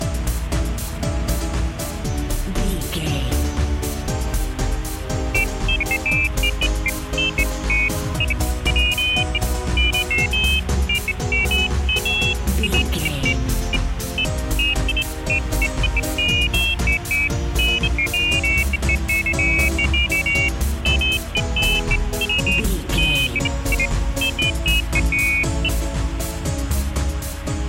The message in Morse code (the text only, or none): none